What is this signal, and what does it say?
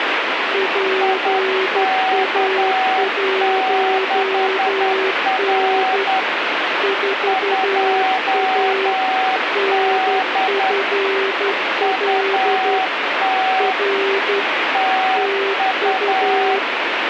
Morse code, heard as two keyed tones, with radio static. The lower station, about 12 wpm, 390 Hz: PA1N 4A NFL R TU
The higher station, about 10 wpm, 760 Hz: IK6R 2D UT TU